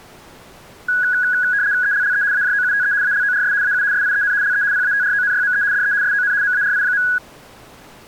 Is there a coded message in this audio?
Yes: RTTY (75 baud, 170 Hz shift) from 0.9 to 7.2 s, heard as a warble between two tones, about 1550 Hz centre. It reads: ELLE AJOUTE ALORS AU SIEN LE PATRONYME DE SON MARI.